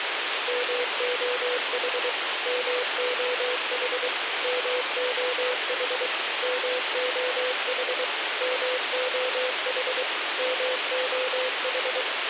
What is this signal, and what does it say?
Morse code, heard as a keyed tone, machine-sent, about 23 wpm, 500 Hz, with radio hiss and a squelch burst at the end. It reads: MOH MOH MOH MOH MOH MOH